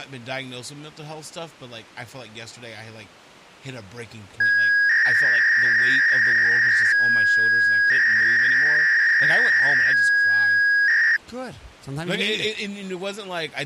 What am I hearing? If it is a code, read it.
300-baud modem data (V.21 tones), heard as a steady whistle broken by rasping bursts, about 300 baud, 200 Hz shift, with speech in English.